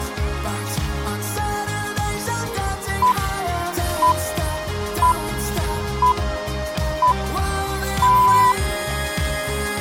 Radio time signal (six pips, as the Greenwich Time Signal), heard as pips.